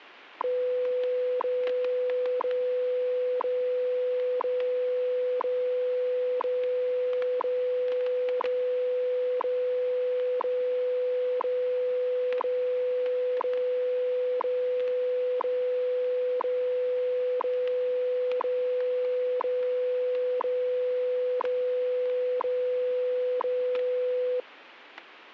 Radio time signal (WWV, Colorado), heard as ticks, one a second, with static crashes.